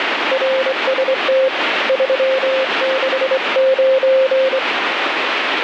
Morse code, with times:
0.3-1.5 RST
1.9-4.6 369

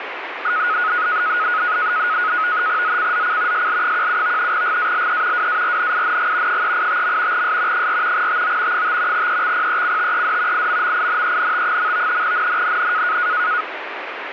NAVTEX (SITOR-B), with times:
2.8-3.7 ZCZC
3.5-4.5 SL17
4.5-5.5 GALE
5.3-6.6 WARNING
6.5-7.4 385.
7.3-7.9 S
7.7-8.3 4
8.1-8.8 TO
8.7-9.3 5
9.1-10.7 EXPECTED
10.5-12.2 IMMINENT.
12.2-13.2 NNNN

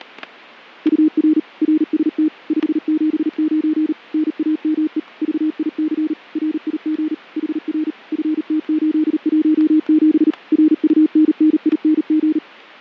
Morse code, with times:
0.9-1.4 UR
1.6-2.3 RST
2.5-3.9 579
4.1-5.0 NAME
5.2-6.1 VIC
6.4-7.1 RIG
7.4-7.9 HR
8.1-10.3 FT817
10.5-12.4 RUNNING

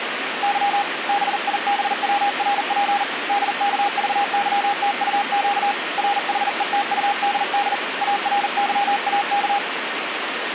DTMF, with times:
none

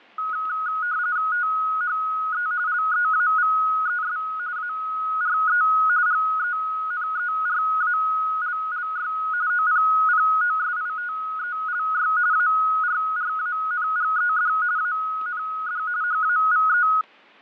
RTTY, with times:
1.3-2.5 THE
2.7-4.2 LEAVES
4.6-5.6 ARE
6.1-9.1 GENERALLY
9.5-12.1 OPPOSITELY
12.3-14.5 ARRANGED
14.8-15.8 AND
16.0-16.9 HAVE

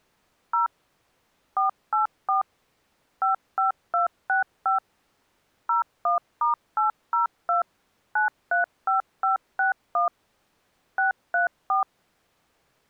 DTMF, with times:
0.5-0.7 0
1.6-2.4 484
3.2-4.8 55265
5.7-7.6 01*802
8.2-10.1 935561
11.0-11.8 634

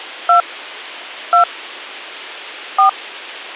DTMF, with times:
0.3-0.4 2
1.3-1.4 2
2.8-2.9 4

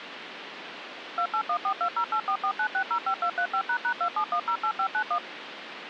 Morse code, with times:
none

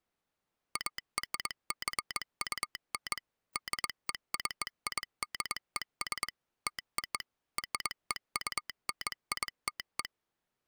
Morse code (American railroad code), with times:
0.8-3.2 ARJUN
3.6-6.3 DECIDES
6.7-7.2 TO
7.6-10.0 REUNITE

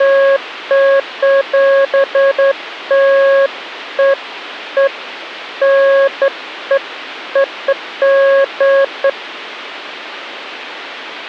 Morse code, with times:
none

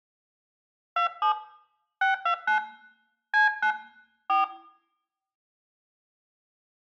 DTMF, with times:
1.0-1.3 27
2.0-2.6 629
3.3-3.7 C9
4.3-4.4 4

